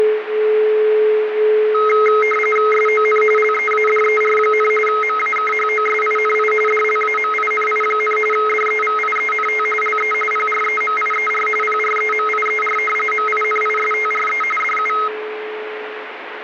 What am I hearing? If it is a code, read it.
RTTY (45.45 baud, 850 Hz shift), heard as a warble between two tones, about 1700 Hz centre, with radio static. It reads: SON LEADER, MAKHOSINI DLAMINI, DEVIENT LE PREMIER PREMIER MINISTRE DU